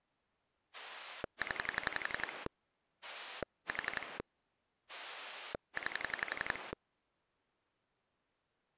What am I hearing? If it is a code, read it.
Pulse dialling, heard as a rotary dial, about 11 pulses a second. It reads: 0 4 9